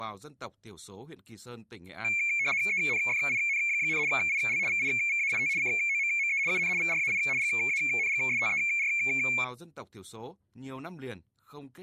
RTTY (75 baud, 170 Hz shift), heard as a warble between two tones, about 2300 Hz centre, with speech in Vietnamese. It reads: ENFIN, IL VIVAIT COMME UN VRAI GANGSTER